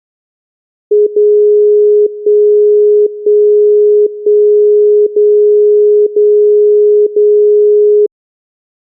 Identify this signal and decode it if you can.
Radio time signal (DCF77), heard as a tone whose level steps once a second, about 420 Hz. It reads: 0 1 1 1 0 0 0